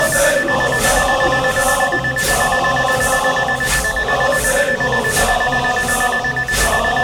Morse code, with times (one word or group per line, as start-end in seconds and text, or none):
none